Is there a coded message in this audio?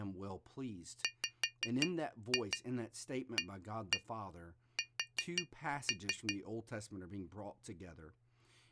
Yes: tap code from 1.0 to 6.4 s, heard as taps on glass, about 5 knocks a second, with speech in English. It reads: WAS